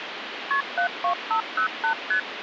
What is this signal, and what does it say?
Multi-frequency trunk signalling (R1, as on North American trunks), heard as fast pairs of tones, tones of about 100 ms, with phone line noise. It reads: KP 72508 ST